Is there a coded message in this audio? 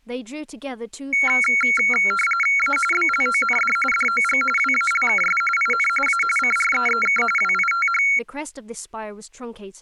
Yes: RTTY (45.45 baud, 850 Hz shift) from 1.1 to 8.2 s, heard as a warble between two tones, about 1800 Hz centre, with speech in English. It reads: A BLOND DOG WALKS IN A CREEK WITH